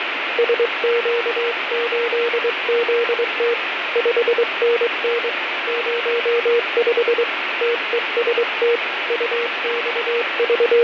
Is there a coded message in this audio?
Yes: Morse code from 0.3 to 10.8 s, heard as a keyed tone, hand-sent with a straight key, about 23 wpm, 470 Hz, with radio static and fading. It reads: SQ8ZT 5NN 05 TEST …